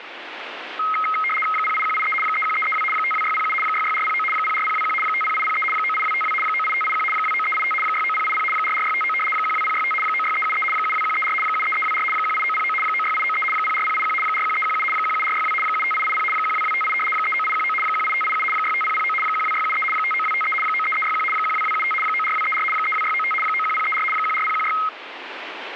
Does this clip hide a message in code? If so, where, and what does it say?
Yes: RTTY (75 baud, 850 Hz shift) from 0.8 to 24.9 s, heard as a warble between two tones, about 1700 Hz centre, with radio static. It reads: 08183 31332 52607 66409 04021 50803 98252 98581 29385 69080 44659 12065 96373 72134 73324 18909 96893 04081 41317 17462 75880 12258 39819 18587 65009 12673 59253 93361 12275 94234 32695 91034 14016